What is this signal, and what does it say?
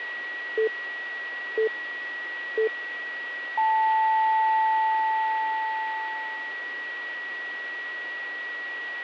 Radio time signal (three low pips and a long one an octave up, as on NHK), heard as pips, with a steady whistle near 1920 Hz.